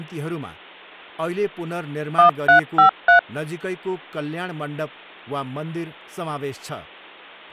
DTMF, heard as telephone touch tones, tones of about 110 ms, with speech in Nepali. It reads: 1353